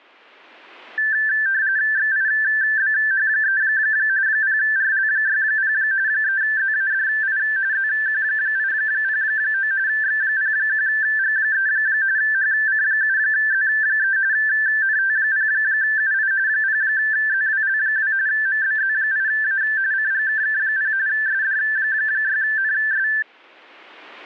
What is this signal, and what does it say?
RTTY (45.45 baud, 170 Hz shift), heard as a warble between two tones, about 1650 Hz centre. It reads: XIBH3 0RL60 3ZADI ZQ809 X01G3 HC7Z3 NT0UI 0ZWL2 MBZ8A CGKK0 SD6NS